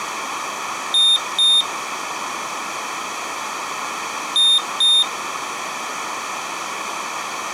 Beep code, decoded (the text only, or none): 2 short